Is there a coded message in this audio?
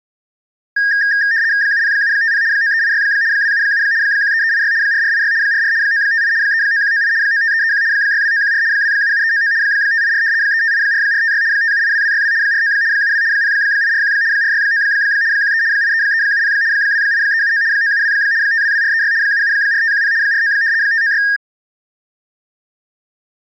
Yes: RTTY (75 baud, 170 Hz shift) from 0.8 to 21.4 s, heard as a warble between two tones, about 1750 Hz centre. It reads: 70750 9386 277 13386 4486 44 958 39198 95331 62914 277399 584 3584456 5782262 49 72 0841 469 13 83370 28379 972 522436 774510 49 596